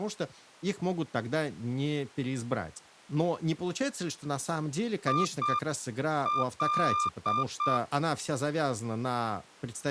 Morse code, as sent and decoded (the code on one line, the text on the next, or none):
.. .-..
IL